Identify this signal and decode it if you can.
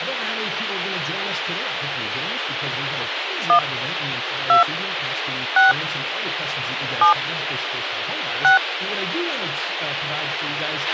DTMF, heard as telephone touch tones, dialled by hand, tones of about 120 ms, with radio hiss and a squelch burst at the end. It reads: 1 2 6 7 6